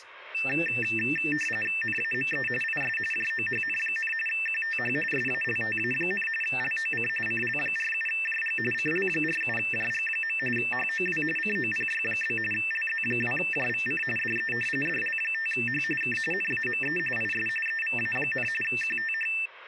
RTTY (45.45 baud, 850 Hz shift), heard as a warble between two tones, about 2250 Hz centre, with speech in English. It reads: NAME IS JOHN, QTH SALTA, LOC CL47JG CL47JG. HOW COPY? LZ2JVC DE DL5H K NAME IS EVA, QTH